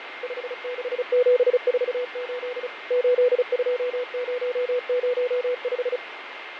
Morse code, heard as a keyed tone, machine-sent, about 35 wpm, 500 Hz, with radio static, fading and a steady whistle near 2110 Hz. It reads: 56748 82005